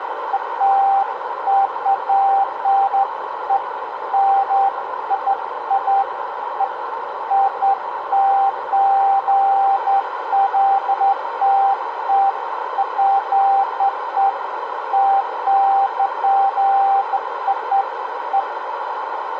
Beeps of irregular length, with radio static, a narrow filter and room echo. There is no code.